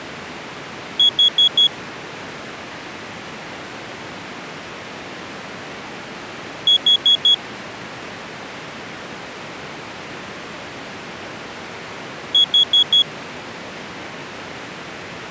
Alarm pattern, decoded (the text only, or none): temporal four